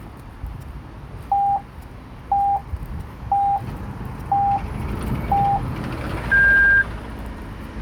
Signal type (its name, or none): radio time signal